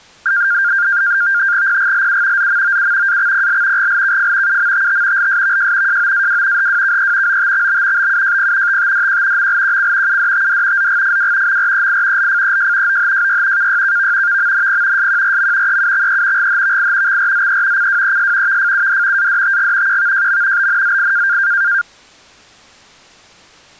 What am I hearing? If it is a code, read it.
NAVTEX (SITOR-B), 100 baud, 170 Hz shift, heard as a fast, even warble, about 1500 Hz centre. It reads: PGLU ZMOU AXPL GLKF UMTT LSVJ JOAW HWKE OTXB BUJP TTDQ MLQC UDTD ZGFW MREI LFEJ OHJY KYKV VMNP SQRM EUXE GHVI XRZE CWES VFUD ADTG QVJM BNZI